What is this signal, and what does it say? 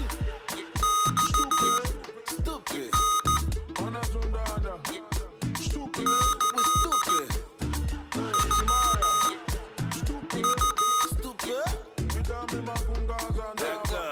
Morse code (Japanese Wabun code), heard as electronic beeps, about 14 wpm, spaced as for 6 wpm, 1250 Hz, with room echo. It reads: マタ キノウ